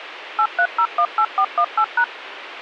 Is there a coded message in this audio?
Yes: DTMF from 0.4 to 2.0 s, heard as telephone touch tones, dialled by machine, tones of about 70 ms, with radio hiss. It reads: 83018418#